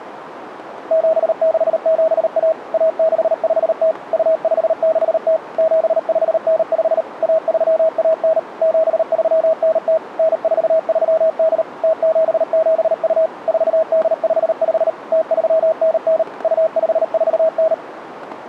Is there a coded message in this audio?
Yes: Morse code (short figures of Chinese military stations) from 0.8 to 17.8 s, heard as a keyed tone, machine-sent, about 38 wpm, 640 Hz, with radio static. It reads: 7671 1650 2560 7595 1319 7390 9438 0772 4855 0399 2549